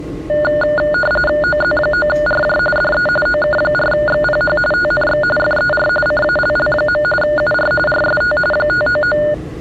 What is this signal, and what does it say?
RTTY (45.45 baud, 850 Hz shift), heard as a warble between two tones, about 1020 Hz centre, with the noise inside a subway train. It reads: OZ9RJ DE OK4XPH TNX FER CALL. UR RST 599